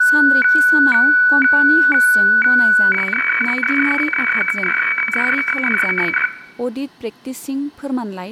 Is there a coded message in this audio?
Yes: weather fax (radiofax), 120 lines a minute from 0.0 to 6.3 s, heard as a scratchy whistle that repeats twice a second, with room echo and speech in Bodo.